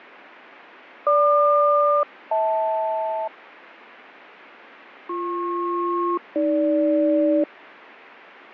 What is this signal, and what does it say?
Aircraft SELCAL, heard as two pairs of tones, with radio static and fading. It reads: GQ-HL BP-AG